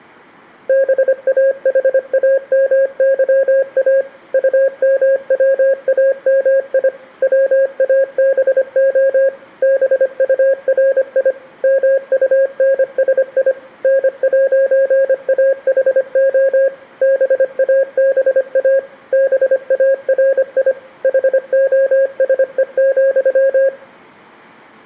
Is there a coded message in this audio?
Yes: Morse code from 0.6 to 23.7 s, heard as a keyed tone, machine-sent, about 25 wpm, 540 Hz. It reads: BAHAMYA UMWAMI WABO BURI MUNSI N'AHO BABA BARI HOSE,